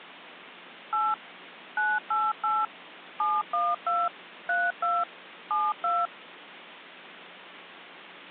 DTMF, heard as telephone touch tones, dialled by machine, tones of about 220 ms. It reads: 8 988 712 32 72